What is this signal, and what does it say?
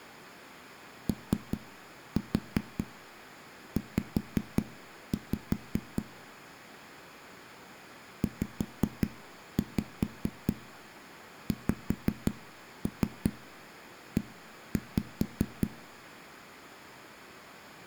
Tap code, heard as knocks on a wall, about 5 knocks a second, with room echo. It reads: OZ ZXE